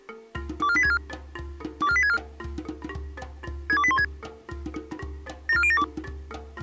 Five-tone selective call (ZVEI), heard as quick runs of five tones, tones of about 70 ms. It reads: 24864 24864 62816 74072